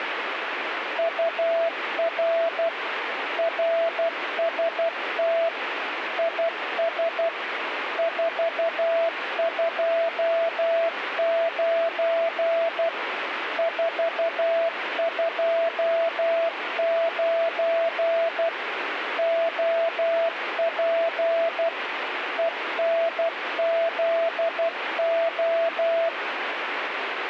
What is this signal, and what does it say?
Morse code, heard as a keyed tone, machine-sent, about 12 wpm, 670 Hz, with radio static. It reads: UR RST IS 429 429 OP ENZO